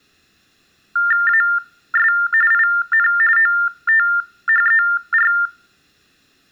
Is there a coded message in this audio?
Yes: TTY/TDD text telephone tones (45.45 baud Baudot) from 1.0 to 5.5 s, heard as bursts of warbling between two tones, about 400 Hz shift, 1600 Hz centre. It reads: AS IN OTHER